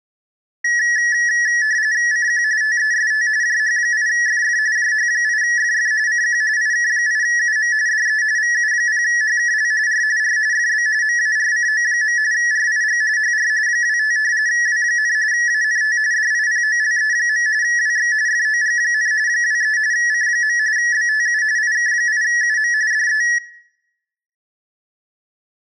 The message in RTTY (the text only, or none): CQ TEST JH8FF JH8FF CQ IK8UM DE VU0HKL R R FB MARCO. RIG HR 25 W, ANT DIPOLE. WX FOG, 23 C. BTU IK8UM DE